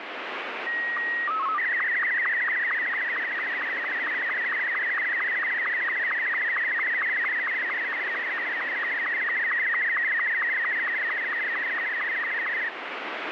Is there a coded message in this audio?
Yes: SSTV (slow-scan television), Martin M2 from 0.7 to 12.7 s, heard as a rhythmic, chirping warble, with radio static.